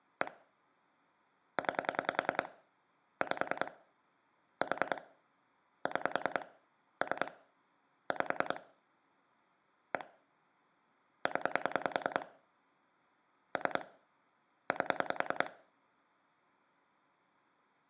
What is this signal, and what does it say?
Pulse dialling, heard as clicks on a phone line, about 10 pulses a second, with room echo. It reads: 1 9 5 4 6 3 5 1 0 3 8